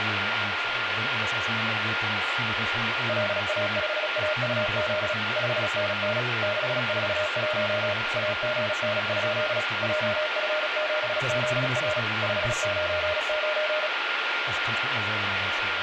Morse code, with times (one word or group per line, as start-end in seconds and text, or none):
3.1-5.1 LA5AUZ
5.4-6.2 5NN
6.4-7.9 641
8.2-9.6 AGN?
9.8-12.0 JF7ZR
12.2-13.9 599